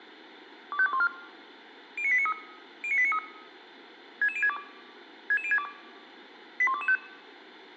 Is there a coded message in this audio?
Yes: five-tone selective call (ZVEI) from 0.7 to 7.0 s, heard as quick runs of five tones, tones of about 70 ms. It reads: 25214 09893 09893 66062 66062 81225